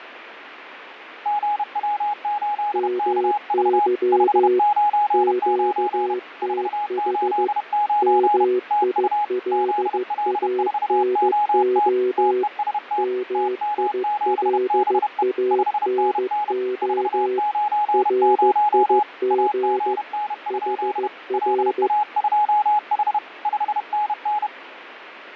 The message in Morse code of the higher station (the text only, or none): GW8KV 599 489 TU ZL4OT TEST TM7BE 5NN 490 AGN? LA2H 5NN